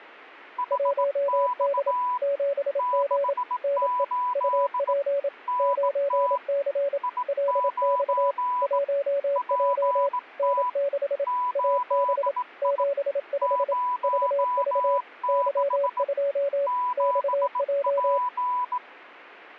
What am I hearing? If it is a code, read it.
Morse code, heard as two keyed tones. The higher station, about 18 wpm, 990 Hz: HX 68 NT I9 PT 8I 06 7P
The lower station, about 27 wpm, 560 Hz: 1D 7G NE UP 9C LX 1J N6 AB 75 VV Y2 XJ